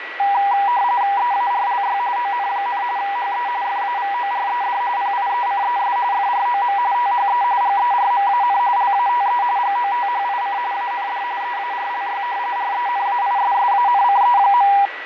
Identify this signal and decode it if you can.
RTTY (45.45 baud, 170 Hz shift), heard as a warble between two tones, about 880 Hz centre, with radio static, fading and a steady whistle near 1940 Hz. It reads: EARLY ON, HE FAVORED PIECES FROM THE GERMAN LATE GOTHIC AND EARLY RENAISSANCE.